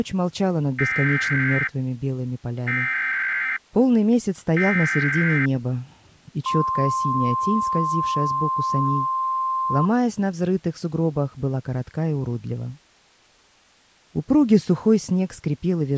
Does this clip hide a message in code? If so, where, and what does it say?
Yes: Emergency Alert System (SAME) tones (header bursts, then the 1050 Hz attention tone) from 0.8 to 9.9 s, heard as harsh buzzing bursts, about 520.83 baud.